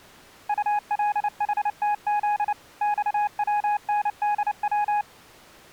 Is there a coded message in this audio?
Yes: Morse code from 0.4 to 5.1 s, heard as a keyed tone, machine-sent, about 29 wpm, 830 Hz. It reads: ULHTZ XWNDW